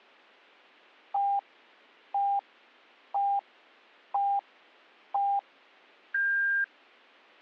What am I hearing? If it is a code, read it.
Radio time signal (five pips and a higher one, as on Chinese radio), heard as pips, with a squelch burst at the end.